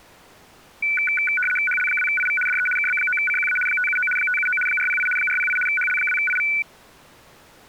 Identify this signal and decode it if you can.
RTTY (75 baud, 850 Hz shift), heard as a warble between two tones, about 1900 Hz centre. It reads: HL2IV DE KB9CQA 579 579 408 408 HL2IV